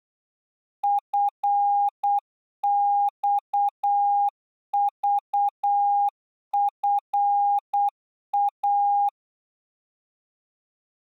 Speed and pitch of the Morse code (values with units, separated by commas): 8 wpm, 810 Hz